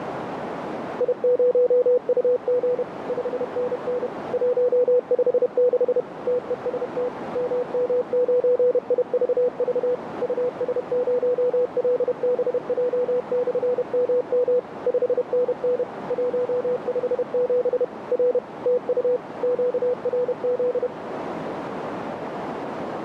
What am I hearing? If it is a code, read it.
Morse code, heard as a keyed tone, machine-sent, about 31 wpm, 500 Hz, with radio static and a narrow filter. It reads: I0UG 5NN 156 TEST MM9IVV US0LBJ/MM 5NN 157 R TU QRZ